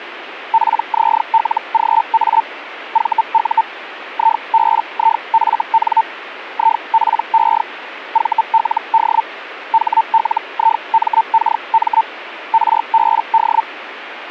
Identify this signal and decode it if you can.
Hellschreiber (Feld-Hell, 122.5 baud), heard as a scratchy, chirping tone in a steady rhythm, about 900 Hz, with radio static. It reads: PZLGA VU IBIFN IPE VLD HLIMKM RBD